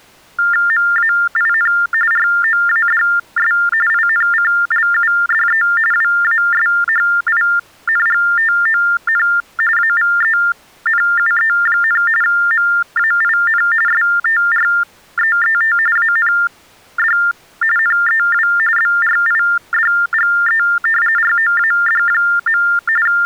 TTY/TDD text telephone tones (45.45 baud Baudot), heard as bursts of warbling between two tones, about 400 Hz shift, 1600 Hz centre. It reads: MAIN ROADS INCLUDE WASHINGTON AVENUE, MAIN STREET AND NEW BRIDGE ROAD. …